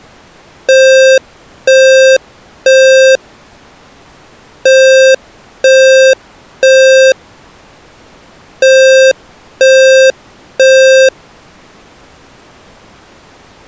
Alarm pattern, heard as an alarm's beeps, played three times, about 530 Hz. Temporal three. Smoke or fire, evacuate.